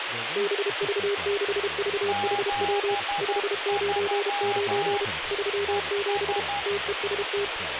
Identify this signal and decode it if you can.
Morse code, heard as two keyed tones, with radio static and speech in English. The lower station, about 32 wpm, 400 Hz: BV6VHW 599 37 TEST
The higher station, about 12 wpm, 810 Hz: 73 ES